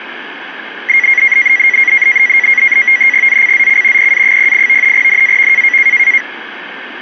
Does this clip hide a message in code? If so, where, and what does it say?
Yes: NAVTEX (SITOR-B), 100 baud, 170 Hz shift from 0.9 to 6.2 s, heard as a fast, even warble, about 2050 Hz centre. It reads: ZCZC PA08 NAV